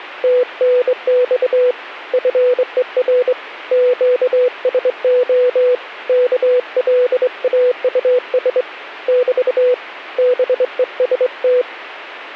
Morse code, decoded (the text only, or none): TNX FER QSO KLAUS <BT> BEST